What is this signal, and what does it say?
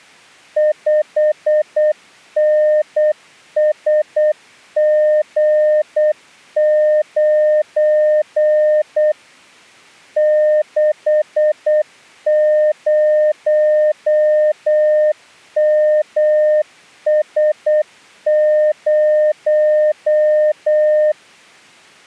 Morse code, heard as a keyed tone, machine-sent, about 8 wpm, 610 Hz. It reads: 5NSG9 60MS0